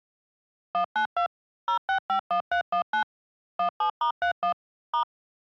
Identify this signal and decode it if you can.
DTMF, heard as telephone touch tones, dialled by machine, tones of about 100 ms. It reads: 192 0651319 17*31 *